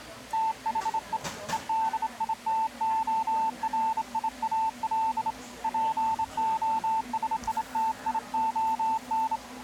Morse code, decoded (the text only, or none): THE EDITORIAL POSITION